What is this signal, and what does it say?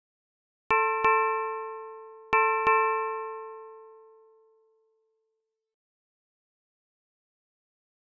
Ship's bell, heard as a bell. 4. Four half-hours of the watch have passed.